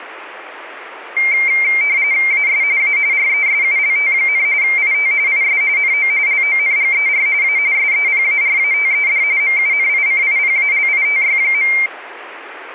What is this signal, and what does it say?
RTTY (45.45 baud, 170 Hz shift), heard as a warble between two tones, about 2200 Hz centre. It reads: AS A RESULT, IT IS NO LONGER A SEPARATED MUNICIPALITY.